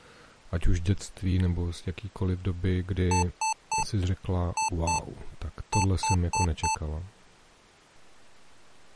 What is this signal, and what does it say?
Beep code, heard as beeps from a small speaker, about 880 Hz, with speech in Czech. 3-2-4. In Phoenix BIOS tables: keyboard controller failure.